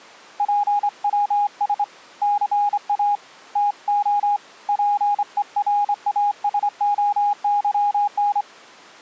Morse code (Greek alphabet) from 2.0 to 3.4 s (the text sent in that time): ΘΑ